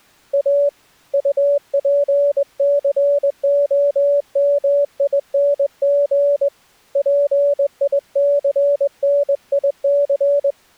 Morse code, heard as a keyed tone, hand-sent with a straight key, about 21 wpm, 570 Hz. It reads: A UPCOMING PICNIC